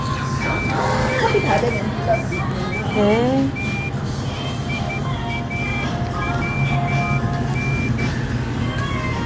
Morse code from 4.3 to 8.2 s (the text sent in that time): IAWN